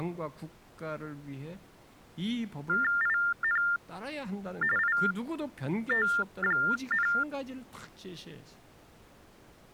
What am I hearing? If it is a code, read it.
TTY/TDD text telephone tones (45.45 baud Baudot), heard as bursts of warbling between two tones, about 400 Hz shift, 1600 Hz centre, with speech in Korean. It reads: IN IT,